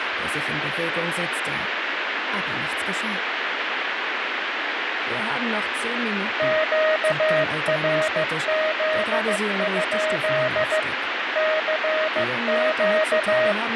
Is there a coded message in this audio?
Yes: Morse code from 6.3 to 13.6 s, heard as a keyed tone, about 15 wpm, 630 Hz, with radio static. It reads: QRZ? CQ